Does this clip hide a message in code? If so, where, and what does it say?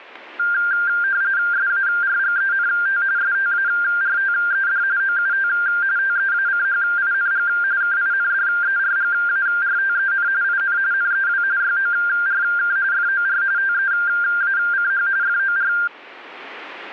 Yes: RTTY (45.45 baud, 170 Hz shift) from 0.4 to 15.9 s, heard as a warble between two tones, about 1500 Hz centre. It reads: SARGENT STARTED OUT TEACHING KINDERGARTEN IN NEW YORK FOR TEACH FOR